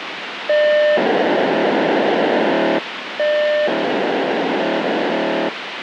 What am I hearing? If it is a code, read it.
POCSAG pager data (1200 baud), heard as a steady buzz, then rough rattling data, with radio hiss.